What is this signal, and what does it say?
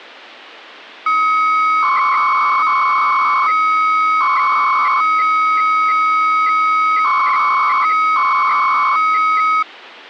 300-baud modem data (Bell 103 tones), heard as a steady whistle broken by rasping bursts, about 300 baud, 200 Hz shift.